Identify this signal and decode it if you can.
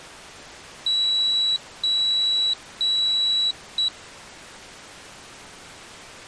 Beep code, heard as a piezo beeper, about 3900 Hz. 3 long, 1 short.